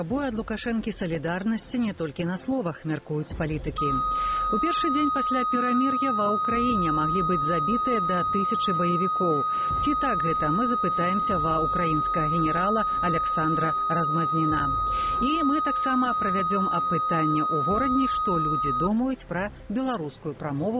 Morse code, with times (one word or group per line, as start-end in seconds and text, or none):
none